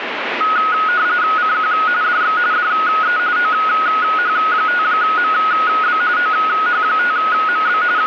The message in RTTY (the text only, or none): CQ DX DE OH5MB OH5MB …